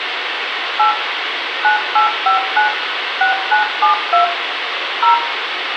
DTMF, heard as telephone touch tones, dialled by machine, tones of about 120 ms, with radio hiss and room echo. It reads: 8 9859 6972 0